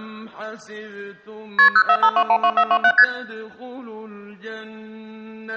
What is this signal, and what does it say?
Multi-frequency trunk signalling (R1, as on North American trunks), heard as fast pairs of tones, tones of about 70 ms. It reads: KP 045212427 ST